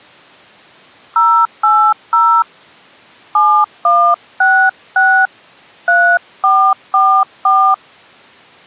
DTMF, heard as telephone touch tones, dialled by hand, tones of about 300 ms. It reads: 080 7166 3444